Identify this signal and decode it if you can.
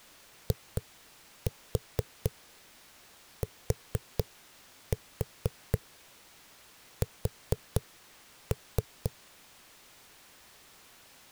Tap code, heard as knocks on a wall, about 4 knocks a second. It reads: ITS